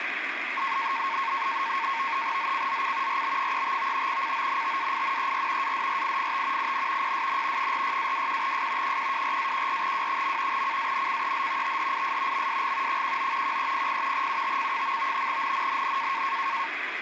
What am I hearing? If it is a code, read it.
NAVTEX (SITOR-B), 100 baud, 170 Hz shift, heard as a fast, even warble, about 1000 Hz centre, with radio static. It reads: ZCZC RB35 CONTAINER ADRIFT IN PSN 46-21S 124-14W. CANCEL THIS MSG 19 1300 UTC. NNNN